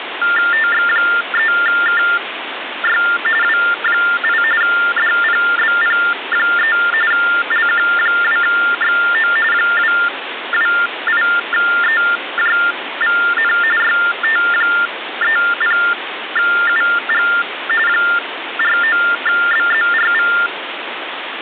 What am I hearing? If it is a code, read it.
TTY/TDD text telephone tones (45.45 baud Baudot), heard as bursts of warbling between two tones, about 400 Hz shift, 1600 Hz centre, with phone line noise. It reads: TX3KY W8 DPBP3 LQ2XO 228EJVN YT30UG 49BZRV